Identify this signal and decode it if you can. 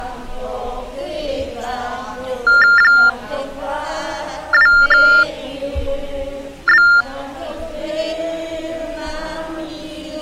TTY/TDD text telephone tones (45.45 baud Baudot), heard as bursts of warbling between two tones, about 400 Hz shift, 1600 Hz centre. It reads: 2B